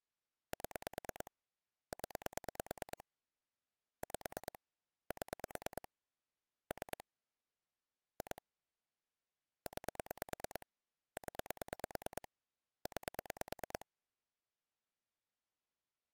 Pulse dialling, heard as clicks on a phone line, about 9 pulses a second. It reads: 7 0 5 7 3 2 9 0 9